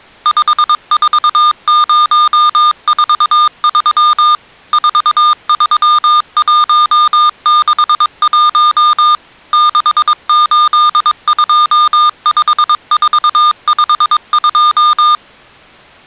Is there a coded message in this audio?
Yes: Morse code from 0.2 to 15.2 s, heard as electronic beeps, machine-sent, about 22 wpm, 1210 Hz. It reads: 54043 43161 6825452